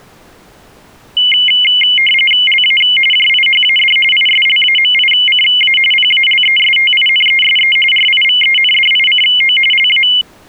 RTTY (45.45 baud, 850 Hz shift), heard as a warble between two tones, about 2550 Hz centre. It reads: LA JIHAD ISLAMICA PALESTINESE RIVENDICO LA